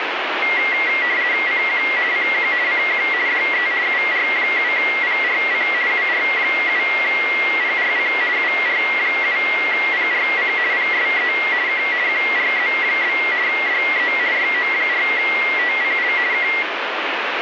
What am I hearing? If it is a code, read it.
RTTY (50 baud, 170 Hz shift), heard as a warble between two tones, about 2050 Hz centre, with radio static. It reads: CQ CQ CQ DE UR7PRC UR7PRC UR7PRC PSE K QRZ? DE YO4TCL K